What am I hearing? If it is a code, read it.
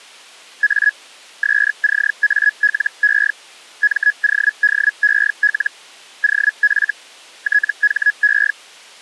Hellschreiber (Feld-Hell, 122.5 baud), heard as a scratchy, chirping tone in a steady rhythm, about 1700 Hz. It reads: A SCALE MODEL OF THE